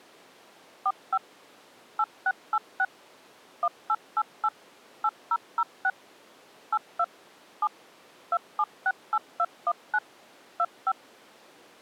DTMF, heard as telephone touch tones, dialled by machine, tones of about 50 ms. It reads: 45 8686 1888 8006 82 7 2768219 25